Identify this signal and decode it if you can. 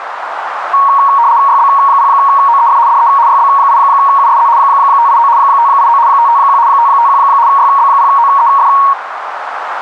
RTTY (75 baud, 170 Hz shift), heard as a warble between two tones, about 1020 Hz centre, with radio static and a narrow filter. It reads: YB0OEF DE YB8USZ 589 589 551 551 YB0OEF